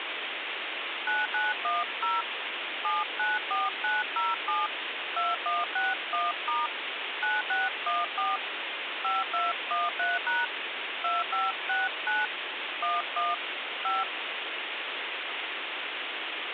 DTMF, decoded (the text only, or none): 9910 794907 2161* 9614 5213# 2569 11 5